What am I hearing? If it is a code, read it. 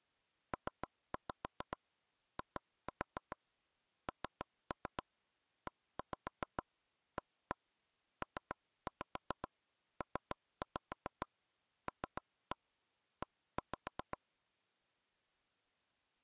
Tap code, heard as taps on a table, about 7 knocks a second. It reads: PINEAPPLE